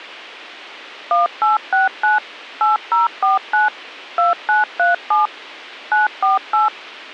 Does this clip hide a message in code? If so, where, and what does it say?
Yes: DTMF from 1.1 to 6.7 s, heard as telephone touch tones, dialled by machine, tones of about 150 ms. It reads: 1869 8049 2937 948